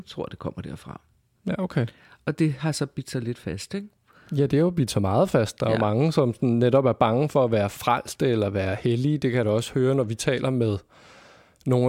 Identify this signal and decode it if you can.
Speech in Danish. There is no code.